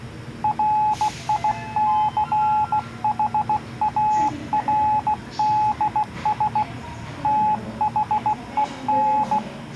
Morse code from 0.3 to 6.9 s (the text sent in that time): RICHARDS